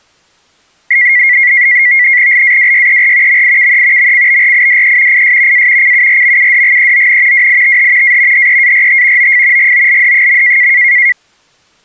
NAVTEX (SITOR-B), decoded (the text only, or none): LAWYER MIKE MCBRIDE IS A CURMUDGEON WITH A HEART OF GOLD.